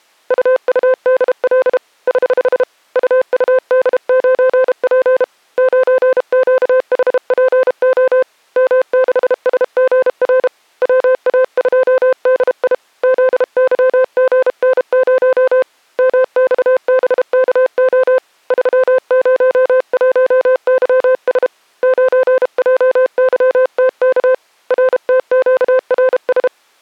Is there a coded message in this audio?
Yes: Morse code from 0.2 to 26.5 s, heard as a keyed tone, hand-sent with a paddle, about 32 wpm, 520 Hz. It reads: UUDL <HH> UUD9P 9QHPO M6SGR WA2DI ZYGN0 MXBKO 301YS 9JYTK RTQRS